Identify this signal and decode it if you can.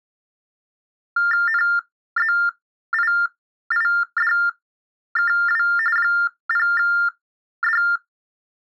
TTY/TDD text telephone tones (45.45 baud Baudot), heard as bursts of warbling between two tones, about 400 Hz shift, 1600 Hz centre. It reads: NZIIDKW 0D